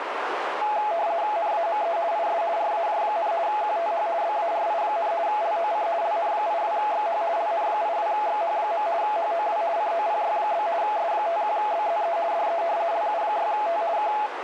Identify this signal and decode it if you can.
RTTY (50 baud, 170 Hz shift), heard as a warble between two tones, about 760 Hz centre, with radio static and a narrow filter. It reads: NAME IS RAJ, QTH BARI, LOC LN82XH LN82XH. HOW COPY? S51BZE DE LU6T K